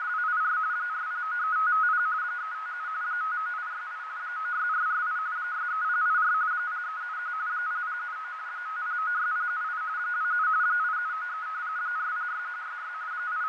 RTTY (45.45 baud, 170 Hz shift), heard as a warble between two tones, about 1360 Hz centre, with radio static, fading and a narrow filter. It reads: … 4093550 357 59868 96448 63084 0371 0079 5096078 27 8793 406166 …